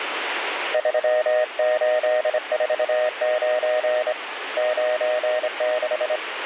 Morse code, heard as a keyed tone, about 26 wpm, 620 Hz, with radio static. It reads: 3849 96